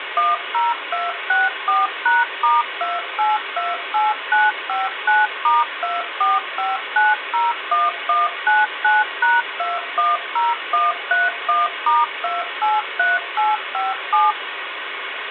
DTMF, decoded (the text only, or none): 10264#*2828959*245901199#210131*283857